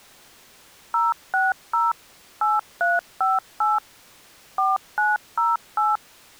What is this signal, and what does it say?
DTMF, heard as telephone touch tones, dialled by machine, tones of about 180 ms. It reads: 060 8358 4908